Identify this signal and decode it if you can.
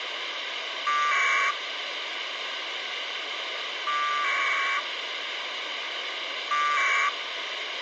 Packet radio (AX.25, as in APRS), 1200 baud, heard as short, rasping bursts, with radio hiss.